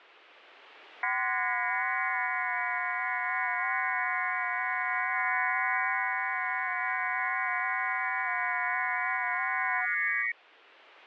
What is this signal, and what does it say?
FT8 (several signals at once), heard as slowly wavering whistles, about 6.25 baud.